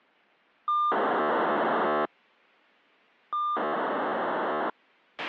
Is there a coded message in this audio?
Yes: POCSAG pager data (2400 baud) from 0.7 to 4.7 s, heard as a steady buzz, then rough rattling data, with a squelch burst at the end.